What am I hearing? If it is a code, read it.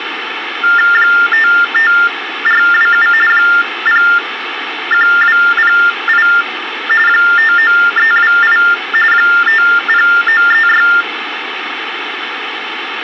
TTY/TDD text telephone tones (45.45 baud Baudot), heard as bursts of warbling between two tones, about 400 Hz shift, 1600 Hz centre, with phone line noise. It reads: 55427 01208 59328 50936